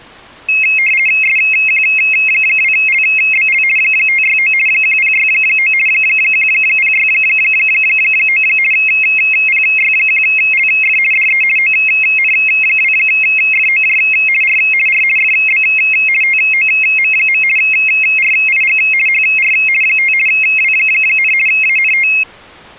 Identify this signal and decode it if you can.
RTTY (50 baud, 450 Hz shift), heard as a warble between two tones, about 2350 Hz centre. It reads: SQ2LBL 569 1069 1069 PY1LF DE ON2FOJ R R FB TOM. RIG HR 5 W, ANT